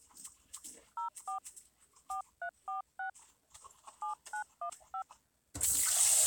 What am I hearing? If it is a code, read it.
DTMF, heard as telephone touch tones, dialled by hand, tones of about 100 ms. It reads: 04 4346 7915